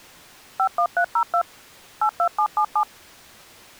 DTMF, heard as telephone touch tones, dialled by machine, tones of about 80 ms. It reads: 51302 82777